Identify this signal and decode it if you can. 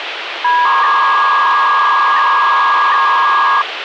300-baud modem data (V.21 tones), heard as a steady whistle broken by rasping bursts, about 300 baud, 200 Hz shift, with phone line noise.